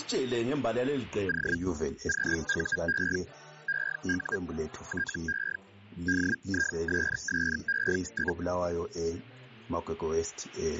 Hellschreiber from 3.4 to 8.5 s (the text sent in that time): EU TE DISSE?